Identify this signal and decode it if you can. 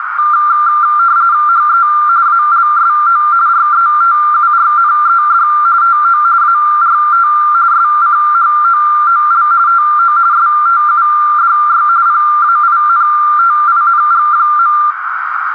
RTTY (45.45 baud, 170 Hz shift), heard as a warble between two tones, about 1280 Hz centre, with radio static and a narrow filter. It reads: HE ALSO RETURNED TO ART SCHOOL TO STUDY PAINTING.